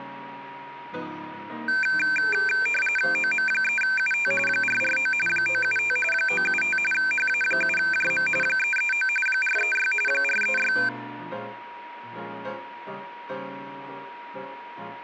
RTTY (45.45 baud, 850 Hz shift), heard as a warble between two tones, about 1950 Hz centre, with a steady whistle near 950 Hz. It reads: OM3UT 449 975 975 HA7JM 339 436 436